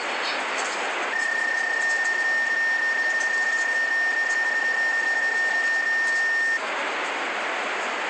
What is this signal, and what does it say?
PSK31 (31.25 baud), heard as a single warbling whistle, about 1800 Hz, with radio static and the noise inside a bus.